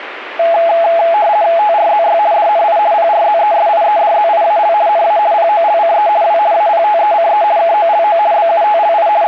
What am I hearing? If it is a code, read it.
RTTY (50 baud, 170 Hz shift), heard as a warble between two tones, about 760 Hz centre, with radio static. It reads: TRZY DNI PRZESIEDZIAL NA POLCE W APTECE KOLO BUTLI …